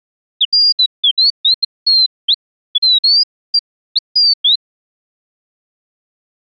Bird-like chirps. There is no code.